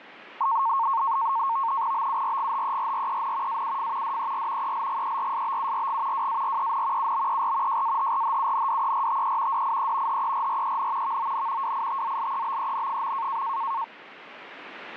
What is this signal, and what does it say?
NAVTEX (SITOR-B), 100 baud, 170 Hz shift, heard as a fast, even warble, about 1000 Hz centre. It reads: BURGHERREN AUF DER ELGERSBURG WAREN UBER JAHRHUNDERTE DIE HERREN VON WITZLEBEN.